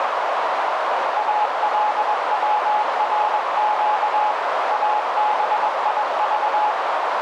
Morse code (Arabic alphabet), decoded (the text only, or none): الورق ابيض